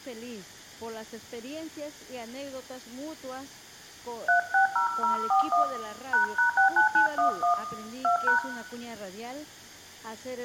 DTMF, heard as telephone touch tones, dialled by hand, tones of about 120 ms, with room echo. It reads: 360041 ##69911 2#